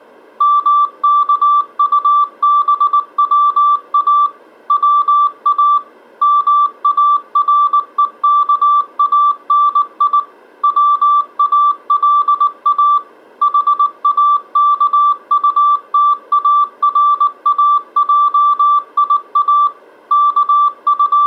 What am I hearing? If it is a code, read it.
Morse code, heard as a keyed tone, machine-sent, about 19 wpm, 1170 Hz. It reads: MKUBWA WA MAREKANI WALA HAKUTARAJIA …